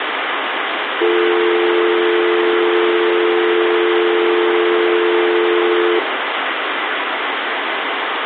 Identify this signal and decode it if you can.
Telephone call progress tone (North American or UK plan), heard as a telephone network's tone, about 350, 440 Hz, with phone line noise and room echo. Dial tone.